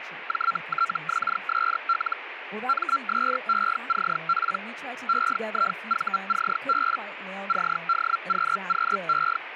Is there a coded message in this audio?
Yes: Hellschreiber (Feld-Hell, 122.5 baud) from 0.3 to 9.4 s, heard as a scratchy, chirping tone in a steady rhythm, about 1360 Hz, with radio static and speech in English. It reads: JTXSL MSECP EIVCB CDQQE